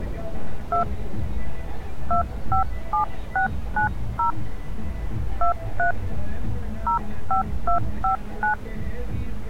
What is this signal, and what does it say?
DTMF, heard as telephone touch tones, dialled by hand, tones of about 110 ms, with street noise. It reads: 2 257690 23 05259